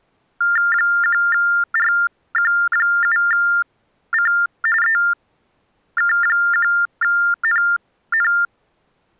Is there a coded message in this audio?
Yes: TTY/TDD text telephone tones (45.45 baud Baudot) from 0.4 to 8.5 s, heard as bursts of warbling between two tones, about 400 Hz shift, 1600 Hz centre. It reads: 1RQ7C EK1NN